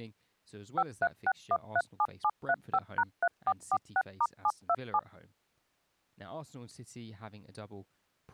DTMF, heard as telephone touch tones, dialled by machine, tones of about 50 ms, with speech in English. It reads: 536137735#3446*727